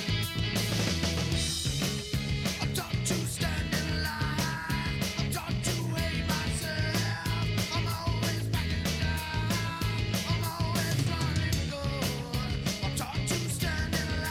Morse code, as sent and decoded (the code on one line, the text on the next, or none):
none